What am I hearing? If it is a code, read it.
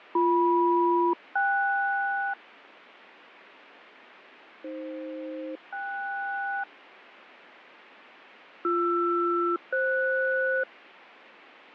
Aircraft SELCAL, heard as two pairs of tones, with radio static and fading. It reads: BM-KS AF-KS BR-FS